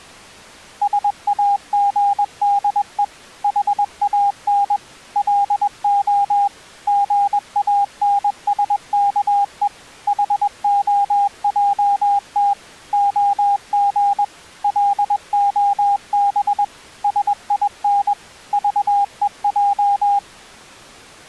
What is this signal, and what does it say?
Morse code, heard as a keyed tone, machine-sent, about 21 wpm, 810 Hz. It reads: SAGDE HAN LO GANSKE HOJT OG LOB SIN VEJ